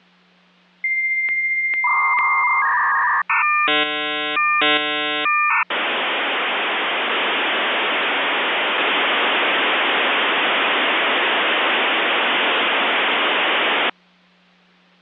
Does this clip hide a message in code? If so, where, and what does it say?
Yes: dial-up modem handshake (V.34 or later) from 0.8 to 13.9 s, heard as a whistle, warbles, then hiss, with hum.